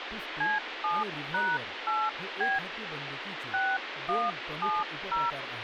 DTMF, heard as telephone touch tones, dialled by hand, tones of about 190 ms, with phone line noise and speech in Marathi. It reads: C7#8B 6170